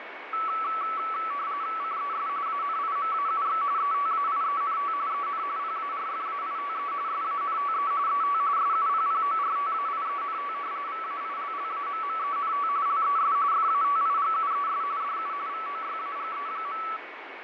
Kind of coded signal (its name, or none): RTTY